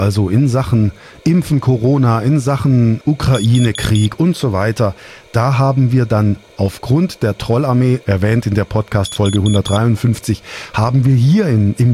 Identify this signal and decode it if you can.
Alarm pattern, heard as an alarm's beeps, played twice, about 3400 Hz, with speech in German. Temporal four. Carbon monoxide.